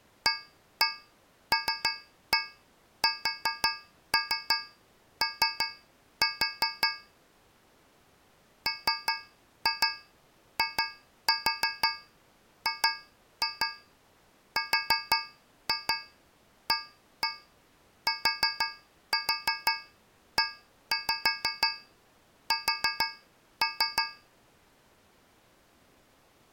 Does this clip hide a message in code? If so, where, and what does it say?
Yes: tap code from 0.3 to 24.4 s, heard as taps on a metal pipe, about 5 knocks a second. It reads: ALSO MIGRATES